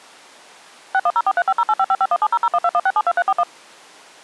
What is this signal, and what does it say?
DTMF, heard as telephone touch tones, dialled by machine, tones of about 50 ms. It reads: 610435085551700121672341